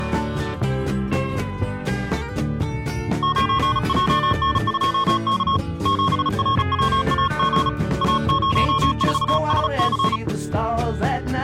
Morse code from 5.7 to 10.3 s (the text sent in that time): 7RWAG A04SC